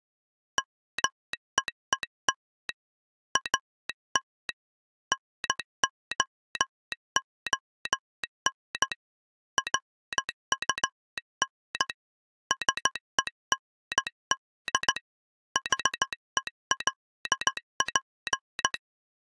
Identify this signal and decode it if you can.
Morse code, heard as a telegraph sounder, hand-sent with a straight key, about 15 wpm. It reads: MEET AT NOON RUN SEND HELP